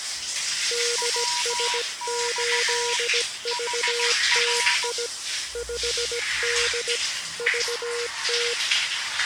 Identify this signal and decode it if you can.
Morse code, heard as two keyed tones, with the noise of a restroom. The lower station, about 17 wpm, 480 Hz: DS8VTI 5D VT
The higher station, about 15 wpm, 970 Hz: WX HR